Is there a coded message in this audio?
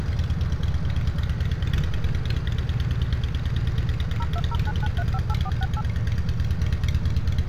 Yes: DTMF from 4.2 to 5.8 s, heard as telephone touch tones, dialled by machine, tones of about 50 ms, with street noise. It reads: 02099358468